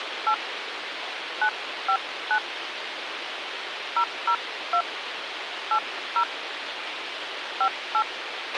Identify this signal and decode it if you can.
DTMF, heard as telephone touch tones, dialled by hand, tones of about 80 ms, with radio hiss and a squelch burst at the end. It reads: 8 959 002 80 58